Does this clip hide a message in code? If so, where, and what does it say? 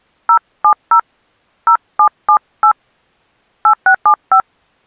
Yes: DTMF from 0.3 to 4.4 s, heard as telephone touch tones, dialled by hand, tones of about 80 ms. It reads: 070 0778 8675